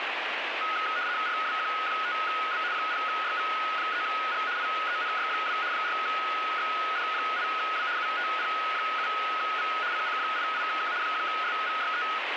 RTTY (75 baud, 170 Hz shift), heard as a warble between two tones, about 1360 Hz centre, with radio static. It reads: RWQ5B 0YV3G IENY2 4XD8W UTP7V CC88K 1SVYE